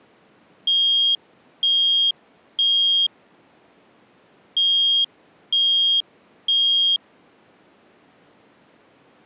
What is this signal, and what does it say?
Alarm pattern, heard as an alarm's beeps, played twice, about 3250 Hz. Temporal three. Smoke or fire, evacuate.